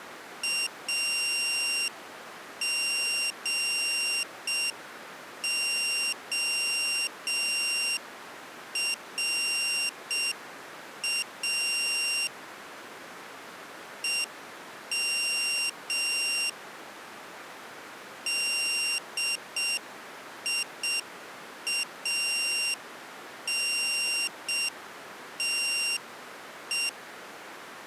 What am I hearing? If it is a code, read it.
Morse code, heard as a high beeper, hand-sent with a straight key, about 6 wpm, 2750 Hz. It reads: AGORA EM DIANTE